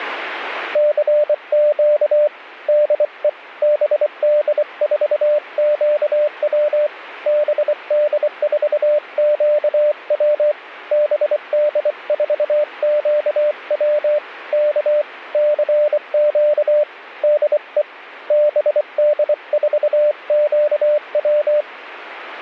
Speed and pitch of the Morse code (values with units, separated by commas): 24 wpm, 600 Hz